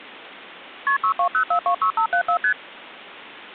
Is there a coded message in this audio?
Yes: multi-frequency trunk signalling (R1, as on North American trunks) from 0.9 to 2.5 s, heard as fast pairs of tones, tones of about 90 ms. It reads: KP 620426574 ST